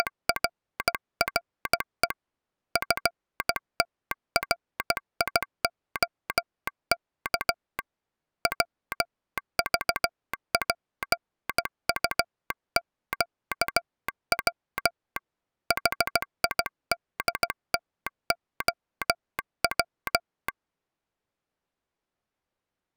Morse code, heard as a telegraph sounder, hand-sent with a bug key, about 16 wpm. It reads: … FTRIOK WVPUQW HIDTOW